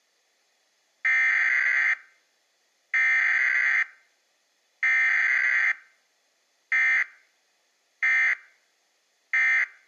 Emergency Alert System (SAME) tones (header bursts, then end-of-message bursts), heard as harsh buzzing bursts, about 520.83 baud.